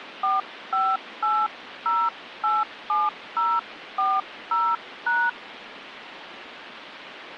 DTMF, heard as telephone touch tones, dialled by hand, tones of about 210 ms, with phone line noise. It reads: 458087040#